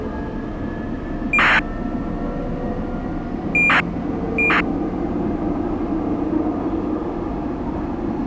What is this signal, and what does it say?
ACARS aircraft data, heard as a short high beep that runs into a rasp, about 2400 baud, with the noise inside a subway train.